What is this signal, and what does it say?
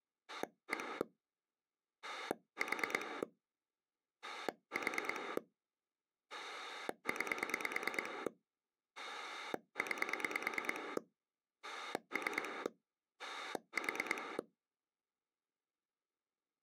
Pulse dialling, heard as a rotary dial, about 9 pulses a second. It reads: 1 4 4 9 9 3 4